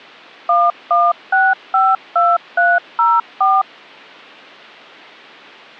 DTMF, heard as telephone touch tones, dialled by machine, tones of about 210 ms. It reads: 11652304